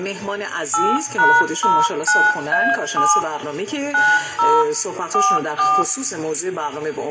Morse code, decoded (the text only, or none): none